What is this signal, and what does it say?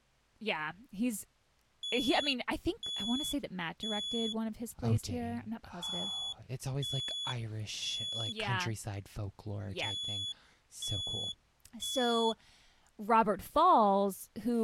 Alarm pattern, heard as an alarm's beeps, played three times, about 3400 Hz, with speech in English. Temporal three. Smoke or fire, evacuate.